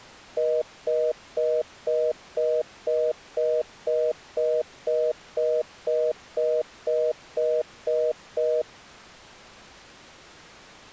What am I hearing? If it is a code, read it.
Telephone call progress tone (North American plan), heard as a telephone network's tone, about 480, 620 Hz, 0.25 s on and 0.25 s off. Congestion tone.